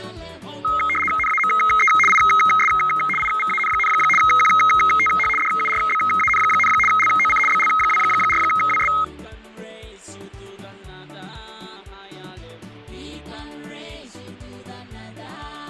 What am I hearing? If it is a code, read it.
RTTY (75 baud, 850 Hz shift), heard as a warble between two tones, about 1700 Hz centre, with fading. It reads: NAME IS IVAN, QTH DURBAN, LOC BL24WS